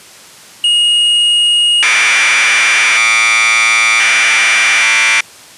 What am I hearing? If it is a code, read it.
Commodore tape loading (standard loader), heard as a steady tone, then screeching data.